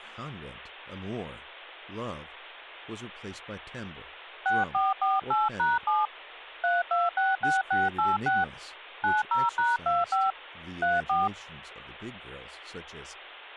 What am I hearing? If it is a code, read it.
DTMF, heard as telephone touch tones, dialled by hand, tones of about 180 ms, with speech in English. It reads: 6448#7 3266686 90#25 34